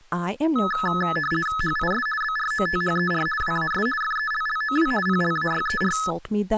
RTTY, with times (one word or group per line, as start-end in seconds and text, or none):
1.6-2.1 HIS
2.2-3.3 BROTHER
3.4-3.9 WAS
4.0-4.9 FELLOW
5.1-6.0 PLAYER